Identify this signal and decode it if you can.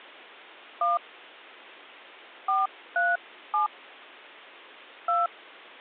DTMF, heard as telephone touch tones, dialled by hand, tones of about 170 ms. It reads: 1 437 2